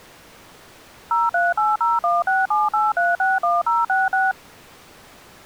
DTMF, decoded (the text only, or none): 03801678361066